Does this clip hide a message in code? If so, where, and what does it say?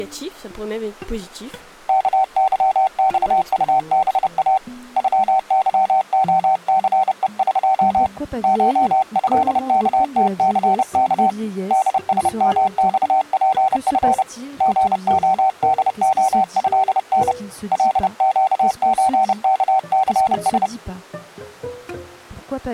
Yes: Morse code (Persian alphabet) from 1.8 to 20.7 s, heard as a keyed tone, hand-sent with a paddle, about 30 wpm, 760 Hz. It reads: کظخطبا غظعثهق شضکتثک دسمخپف ژعدعضن لگچکثس